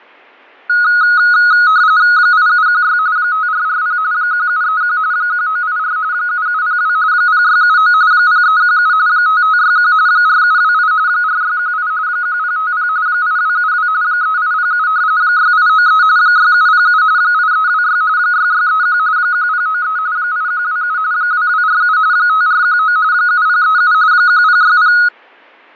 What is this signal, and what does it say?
RTTY (45.45 baud, 170 Hz shift), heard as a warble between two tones, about 1360 Hz centre, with fading. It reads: 8716 5440 1731 1984 7702 0679 0317 5561 4728 4618 1050 8272 3807 6893 6707 8326 6631 1093 8127 2247 5419 7037 1060